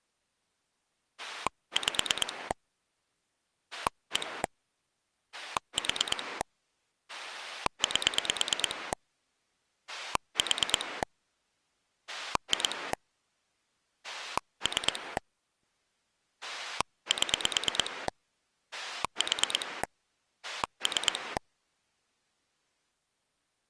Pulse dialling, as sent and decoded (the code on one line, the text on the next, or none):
5 / 1 / 4 / 8 / 4 / 2 / 3 / 7 / 4 / 3
5 1 4 8 4 2 3 7 4 3